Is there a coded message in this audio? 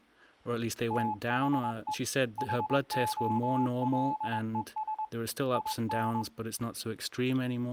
Yes: Morse code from 0.8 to 6.3 s, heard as a keyed tone, hand-sent with a straight key, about 22 wpm, 860 Hz, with speech in English. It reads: THE HOLES IN